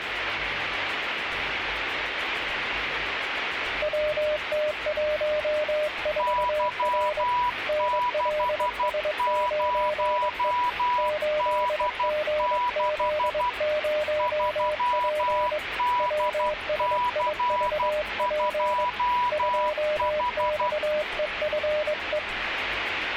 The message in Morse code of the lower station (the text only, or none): WT14R NLS9E 8GZ0P WSIVP 2XEFE